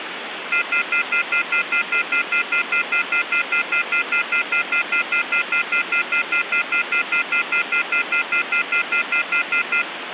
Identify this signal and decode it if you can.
Telephone call progress tone (North American plan), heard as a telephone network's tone, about 1400, 2050, 2450, 2600 Hz, 0.1 s on and 0.1 s off, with phone line noise. Off-hook warning tone.